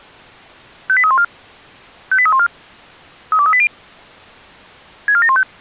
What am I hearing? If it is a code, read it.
Five-tone selective call (ZVEI), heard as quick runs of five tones, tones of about 70 ms. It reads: 58314 58314 32380 64715